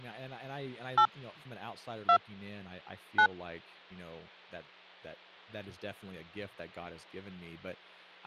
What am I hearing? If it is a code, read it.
DTMF, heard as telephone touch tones, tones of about 80 ms, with hum and speech in English. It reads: 8 2 9